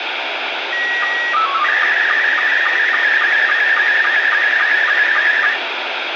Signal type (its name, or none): SSTV (slow-scan television)